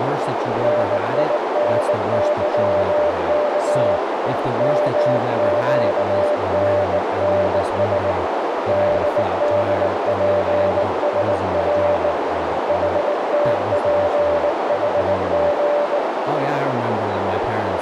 Morse code, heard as a keyed tone, hand-sent with a bug key, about 19 wpm, 590 Hz, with heavy radio static, a narrow filter and speech in English. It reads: NINYK MQNNS DDPSR HTPHG